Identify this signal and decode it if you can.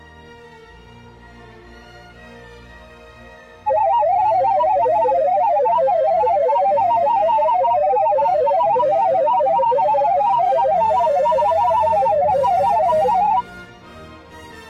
Multi-tone FSK (Olivia or MFSK type), about 500 Hz wide, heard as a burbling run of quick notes, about 31.25 baud.